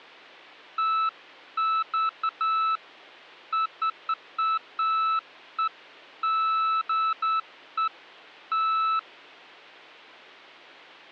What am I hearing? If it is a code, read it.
Beeps of irregular length, with hum. There is no code.